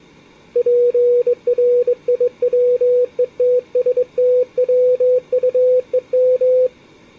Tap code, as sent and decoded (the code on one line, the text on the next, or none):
none